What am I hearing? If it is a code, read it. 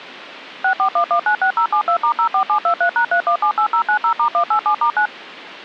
DTMF, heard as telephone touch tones, dialled by machine, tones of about 90 ms. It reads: 641196072*04723#3178090*187*9